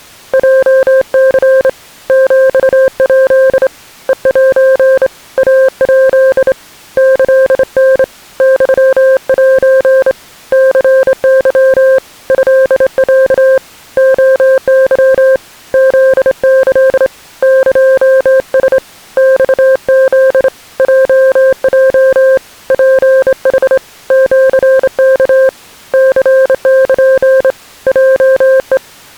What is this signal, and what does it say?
Morse code (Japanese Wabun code), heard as a keyed tone, hand-sent with a straight key, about 27 wpm, 530 Hz. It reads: ヲニ ヒヱ ヘセ イヱ キタ ユセ ニケ トロ レケ フキ エラ マフ ヲヲ ツヌ シワ ニル ヲヘ